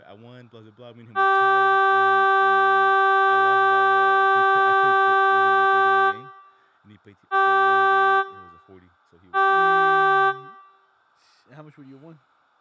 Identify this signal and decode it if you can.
Ship horn signal, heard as a ship's horn, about 390 Hz, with speech in English. 1 long, 2 short. At sea: a vessel in fog that is sailing, fishing, towing or hampered.